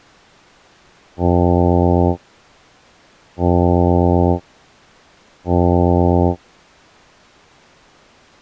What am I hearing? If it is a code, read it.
Ship horn signal, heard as a ship's horn, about 90 Hz. 3 short. At sea: I am operating astern propulsion.